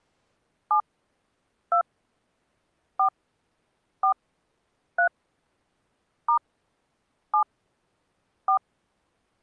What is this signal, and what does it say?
DTMF, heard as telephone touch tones, dialled by hand, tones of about 90 ms. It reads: 7 2 4 4 3 * 7 4